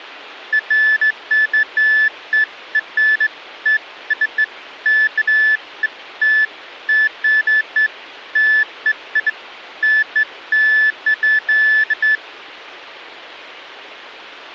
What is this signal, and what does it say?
Beeps of irregular length. There is no code.